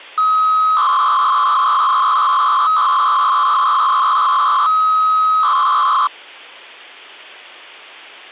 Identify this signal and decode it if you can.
300-baud modem data (Bell 103 tones), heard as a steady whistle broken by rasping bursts, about 300 baud, 200 Hz shift, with hum.